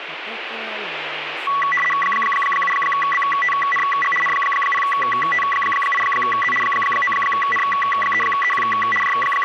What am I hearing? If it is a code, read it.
RTTY (75 baud, 850 Hz shift), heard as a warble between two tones, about 1550 Hz centre, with radio static. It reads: 7BTNG N0T8Z 9N3EQ …